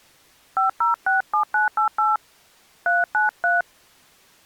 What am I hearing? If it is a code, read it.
DTMF, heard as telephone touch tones, dialled by hand, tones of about 140 ms. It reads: 5067988 393